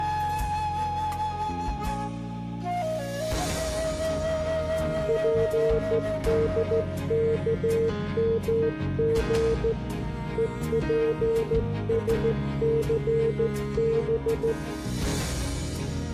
Morse code (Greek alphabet), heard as a keyed tone, hand-sent with a straight key, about 14 wpm, 450 Hz. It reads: ΠΔΚΜΓ ΕΠΣΘΒ